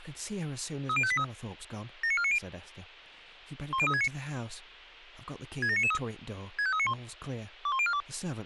Five-tone selective call (ZVEI), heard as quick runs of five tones, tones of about 70 ms, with speech in English. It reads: 30583 79490 10369 67993 65391 21042